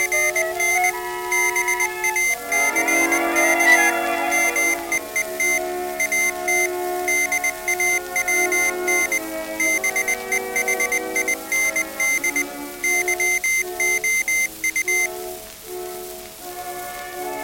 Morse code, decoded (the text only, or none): … BACK MEET AT DAWN BEHIND YOU